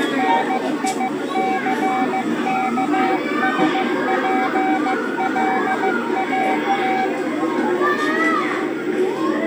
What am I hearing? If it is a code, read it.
Morse code, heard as a keyed tone, hand-sent with a paddle, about 15 wpm, 760 Hz, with the noise of a park. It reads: NICKSPLAT